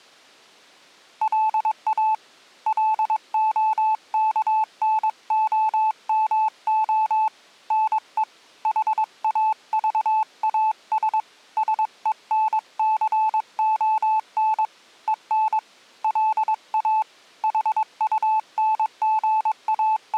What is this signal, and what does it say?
Morse code, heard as a keyed tone, hand-sent with a paddle, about 22 wpm, 870 Hz. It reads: LA LOKNOMO NE HAVAS SENCON EN LA …